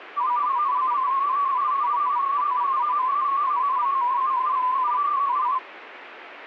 Multi-tone FSK (Olivia or MFSK type), about 250 Hz wide, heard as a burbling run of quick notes, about 31.25 baud.